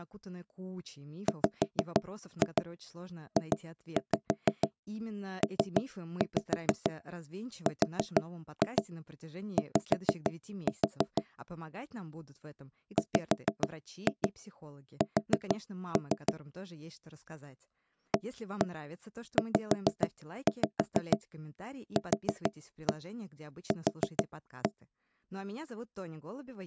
Tap code, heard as knocks on wood, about 6 knocks a second, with speech in Russian. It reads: WJPRY WS AZQQ